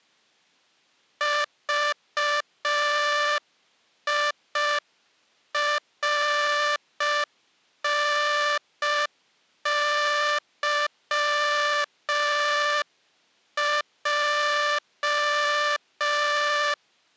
Morse code (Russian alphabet), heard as a buzzer, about 5 wpm. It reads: ЖИРНЫЙ